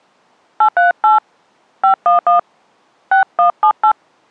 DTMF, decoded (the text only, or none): 838 511 6178